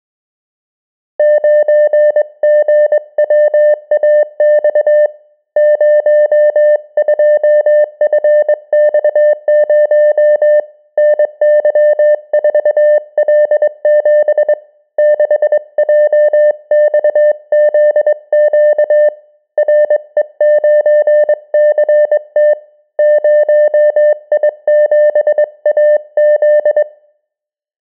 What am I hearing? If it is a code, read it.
Morse code, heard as a keyed tone, hand-sent with a straight key, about 22 wpm, 600 Hz. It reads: 9GWAX 02FX0 NY4L7 6JXZQ RE9CT 0I7AZ